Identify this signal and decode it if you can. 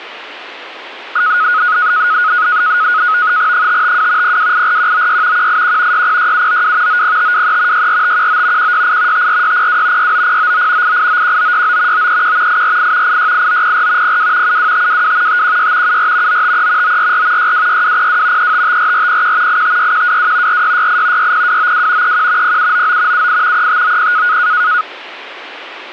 NAVTEX (SITOR-B), 100 baud, 170 Hz shift, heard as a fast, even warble, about 1360 Hz centre. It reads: 552 0284196 181 606792 90523 64519 168 54602 69099 8891969 931 848 868904 02 72522 516 74 953 944 626202 3554401 856122 4668 60292 31 0799 78 3590